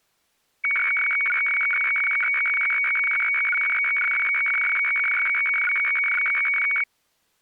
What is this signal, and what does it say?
Weather fax (radiofax), 120 lines a minute, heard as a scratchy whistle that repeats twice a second.